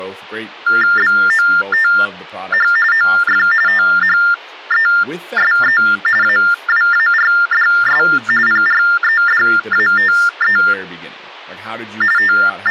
TTY/TDD text telephone tones (45.45 baud Baudot), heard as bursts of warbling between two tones, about 400 Hz shift, 1600 Hz centre, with speech in English. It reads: BOTH OF THESE AWARDS PREDATE …